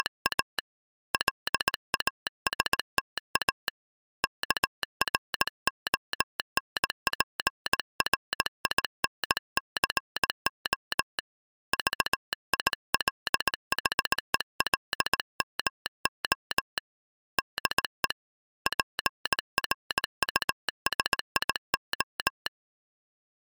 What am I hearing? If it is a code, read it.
Morse code, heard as a telegraph sounder, hand-sent with a paddle, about 18 wpm. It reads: … LASTA KRONPRINCO VILHELMO DE PRUSIO